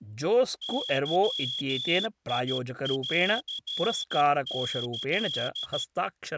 Morse code (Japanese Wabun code), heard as a whistle, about 13 wpm, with speech in Sanskrit. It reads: ゲンキ